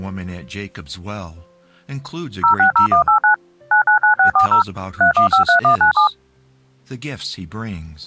DTMF, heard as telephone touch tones, dialled by machine, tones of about 110 ms. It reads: 060189 999640 3153197